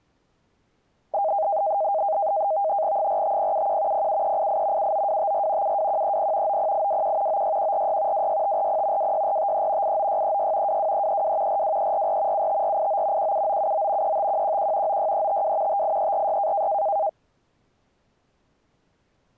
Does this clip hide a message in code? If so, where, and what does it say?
Yes: NAVTEX (SITOR-B), 100 baud, 170 Hz shift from 1.1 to 17.1 s, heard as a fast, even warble, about 720 Hz centre. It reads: 45071 07388 79254 72130 90821 96146 26540 26453 89636 22332 42344 75489 17979 35111 96352 58346